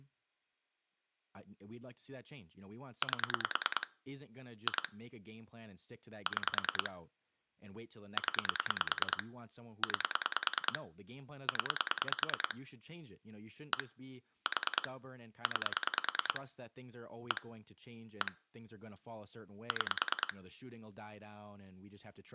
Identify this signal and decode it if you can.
Pulse dialling, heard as clicks on a phone line, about 9 pulses a second, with speech in English. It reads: 8 2 6 0 9 0 1 4 9 1 1 6